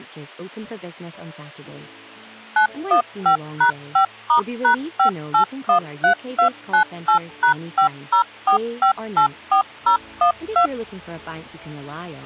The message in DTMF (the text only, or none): 915#5*#5813298#504584012